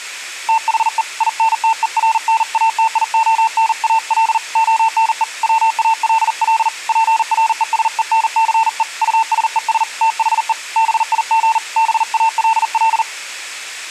Morse code, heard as a keyed tone, hand-sent with a paddle, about 40 wpm, 900 Hz. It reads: THE INTERNATIONAL ONE WALL PRESENCE USES THE BIG BALL